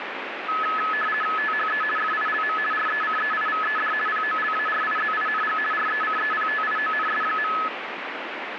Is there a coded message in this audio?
Yes: RTTY (50 baud, 450 Hz shift) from 0.5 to 7.7 s, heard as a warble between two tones, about 1500 Hz centre, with radio static. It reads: THE FILM RECEIVED POLARIZING RECEPTIONS.